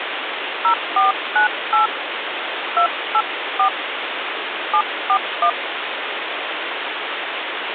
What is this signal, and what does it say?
DTMF, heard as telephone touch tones, dialled by hand, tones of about 100 ms, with phone line noise. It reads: 0498 284 741